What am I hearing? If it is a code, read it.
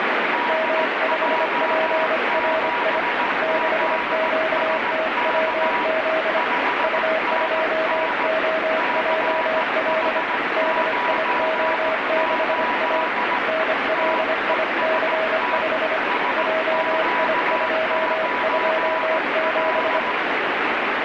Morse code, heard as two keyed tones, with heavy radio static. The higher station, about 17 wpm, 980 Hz: DJ7ZSK 5NN CH98 TEST SQ9L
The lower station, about 25 wpm, 640 Hz: M5PRI 6QTWZ U2OJL DIO6A NLIC5 JI227